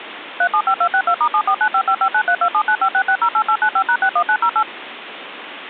DTMF, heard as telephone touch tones, dialled by machine, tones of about 70 ms, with phone line noise. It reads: 375262*7495559327956608895#61908